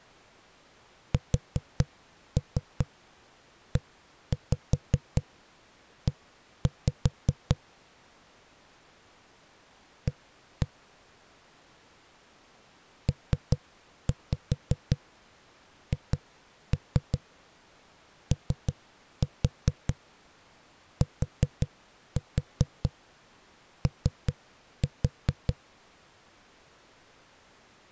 Tap code, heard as knocks on a wall, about 5 knocks a second. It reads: SEE A PHOTO